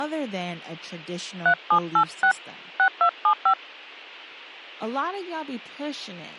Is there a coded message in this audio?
Yes: DTMF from 1.5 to 3.5 s, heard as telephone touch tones, dialled by hand, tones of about 80 ms, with speech in English. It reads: 3786 6275